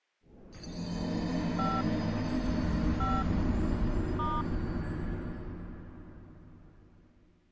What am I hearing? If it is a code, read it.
DTMF, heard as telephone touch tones, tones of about 220 ms. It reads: 5 5 *